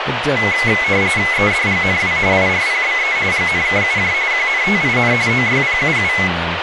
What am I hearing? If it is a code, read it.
RTTY (45.45 baud, 170 Hz shift), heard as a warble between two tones, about 2100 Hz centre, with radio static and speech in English. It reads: EDGNW IRPBE GNKUJ QNTIN OYPUU